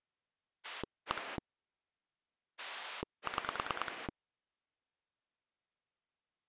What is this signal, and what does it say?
Pulse dialling, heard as a rotary dial, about 9 pulses a second. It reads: 1 6